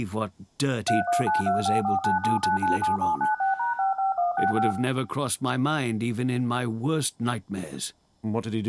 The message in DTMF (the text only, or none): 31925497997796#55165